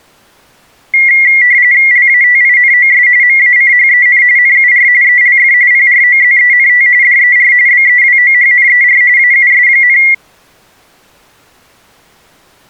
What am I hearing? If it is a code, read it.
RTTY (45.45 baud, 170 Hz shift), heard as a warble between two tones, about 2050 Hz centre. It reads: LATINOS MACHEN NUR ELF PROZENT DER BEWOHNER AUS,